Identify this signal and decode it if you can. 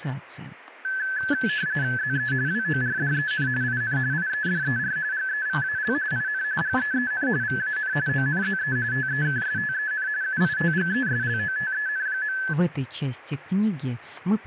RTTY (45.45 baud, 170 Hz shift), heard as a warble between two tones, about 1600 Hz centre, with static crashes. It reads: ZE WORDEN IN IEDER GEVAL IN GEEN VAN ONZE TEKSTEN UITGESLOTEN.